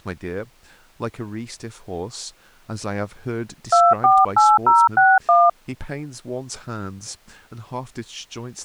DTMF, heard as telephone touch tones, dialled by hand, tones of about 210 ms, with speech in English. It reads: 248061